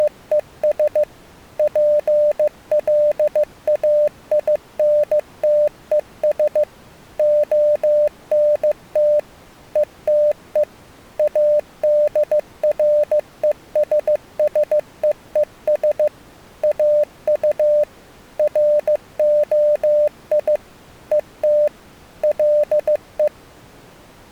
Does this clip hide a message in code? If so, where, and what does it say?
Yes: Morse code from 0.0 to 23.3 s, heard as a keyed tone, machine-sent, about 15 wpm, 600 Hz. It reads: … PLAINTES ONT ETE ADRESSEES AU ROI ET LE